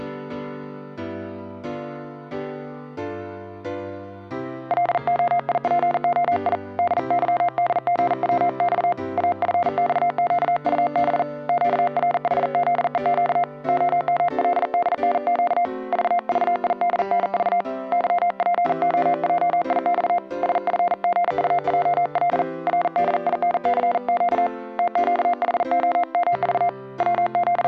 Morse code, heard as a keyed tone, hand-sent with a paddle, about 40 wpm, 700 Hz. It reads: LOIPOI DYDGWX AFXQUB QRHZEQ OMLDNQ VVIDNV YPOJIX SFGUJL RDINCQ TQHOMV …